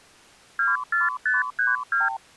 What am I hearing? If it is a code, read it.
Multi-frequency trunk signalling (R2, with the far end's replies), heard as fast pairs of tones, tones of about 170 ms. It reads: 24532